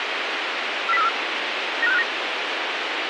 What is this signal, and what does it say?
Five-tone selective call (EEA), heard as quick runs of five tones, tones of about 40 ms, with radio hiss. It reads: 40434 95659